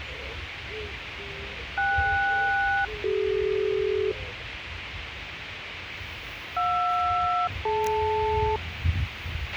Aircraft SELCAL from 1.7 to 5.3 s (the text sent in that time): KS-CD